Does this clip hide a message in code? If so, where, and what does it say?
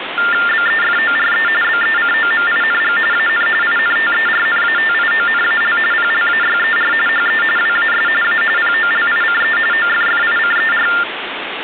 Yes: TTY/TDD text telephone tones (45.45 baud Baudot) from 0.2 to 11.0 s, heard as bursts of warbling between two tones, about 400 Hz shift, 1600 Hz centre, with phone line noise. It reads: BEFORE BECOMING AN INTERNATIONAL PLAYER HE WAS A POLICE OFFICER